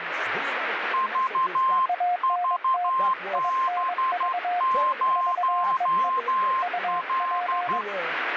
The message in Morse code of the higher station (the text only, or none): VVB0L